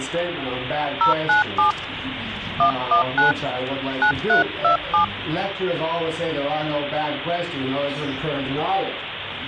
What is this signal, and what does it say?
DTMF, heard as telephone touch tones, dialled by hand, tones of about 120 ms, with phone line noise. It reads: 097 119 9327